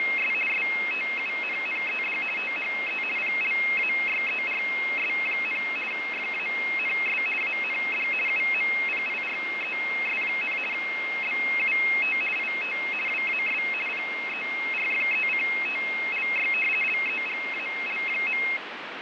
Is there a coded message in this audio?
Yes: RTTY (50 baud, 450 Hz shift) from 0.0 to 18.6 s, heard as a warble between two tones, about 2350 Hz centre, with radio static and fading. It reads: … STUNNED THE PLAYERS, FANS AND UMPIRES, BUT IT WAS PERFECTLY LEGAL.